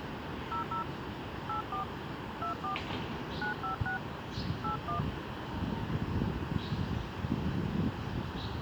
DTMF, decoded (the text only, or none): 00 84 24 956 81